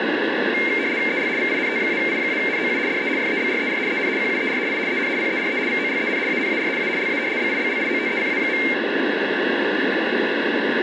RTTY (75 baud, 170 Hz shift), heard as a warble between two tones, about 2200 Hz centre, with radio static. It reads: EL VINT-I-NOU DE FEBRER EN QUER I EN PERE VOLEN ANAR A LA BIBLIOTECA.